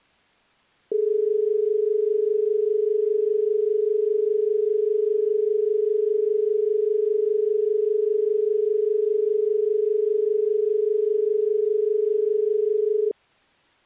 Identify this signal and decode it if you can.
Telephone call progress tone (as in Australia), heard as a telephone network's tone, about 430 Hz. Dial tone.